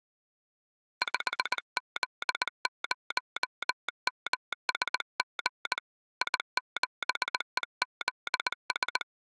Morse code, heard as a telegraph sounder, hand-sent with a paddle, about 19 wpm. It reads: 5Z0MSG I7EZS